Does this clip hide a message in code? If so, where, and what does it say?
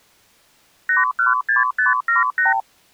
Yes: multi-frequency trunk signalling (R2, with the far end's replies) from 0.9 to 2.6 s, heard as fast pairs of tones, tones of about 150 ms. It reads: 816578